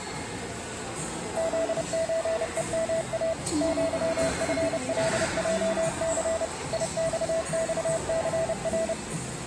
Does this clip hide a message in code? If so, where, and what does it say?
Yes: Morse code (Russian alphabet) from 1.3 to 9.0 s, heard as a keyed tone, machine-sent, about 30 wpm, 660 Hz, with the noise of a subway station. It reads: ЗЧЕМА ЪФЛЙЦ ИЬЬЦР